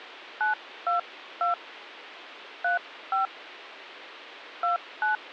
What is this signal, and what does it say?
DTMF, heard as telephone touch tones, dialled by hand, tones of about 130 ms, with phone line noise. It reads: 922 35 29